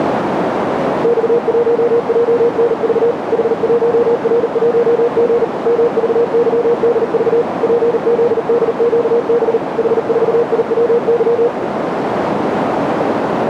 Morse code, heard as a keyed tone, machine-sent, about 39 wpm, 480 Hz, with radio static and a narrow filter. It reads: X1JNV H1R1G MVYDV PZDQB H4IWY